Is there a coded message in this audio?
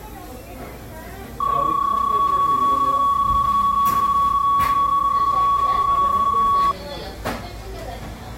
Yes: PSK31 (31.25 baud) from 1.4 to 6.7 s, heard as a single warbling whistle, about 1120 Hz, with the noise of a cafe.